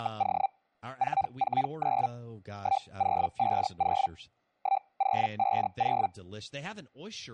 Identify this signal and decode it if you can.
Hellschreiber (Feld-Hell, 122.5 baud), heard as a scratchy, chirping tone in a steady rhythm, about 780 Hz, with speech in English. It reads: … 449 1050 1050